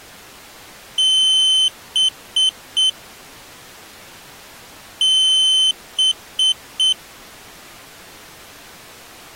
Beep code, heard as a piezo beeper, played twice, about 3050 Hz. 1 long, 3 short. In Award and IBM BIOS tables: video adapter failure; in AMI BIOS tables: memory failure.